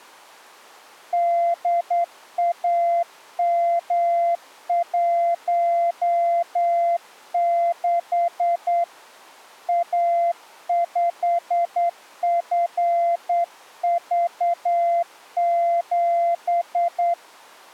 Morse code, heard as a keyed tone, hand-sent with a straight key, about 9 wpm, 690 Hz. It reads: DAM16 A5FV7